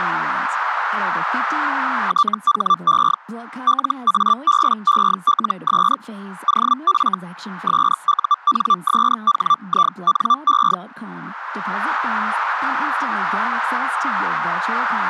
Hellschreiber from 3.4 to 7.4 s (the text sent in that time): LABELS OF